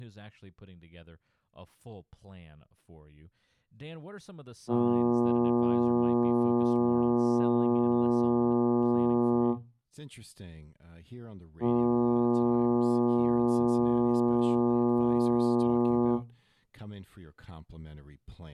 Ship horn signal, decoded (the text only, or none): 2 long